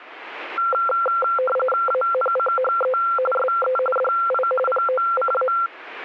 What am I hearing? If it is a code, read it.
RTTY (45.45 baud, 850 Hz shift), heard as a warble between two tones, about 940 Hz centre. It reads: ANCHE SE DI POCA